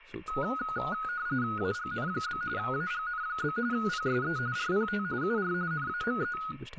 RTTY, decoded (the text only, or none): AGN? AGN? PSE RPT UR NAME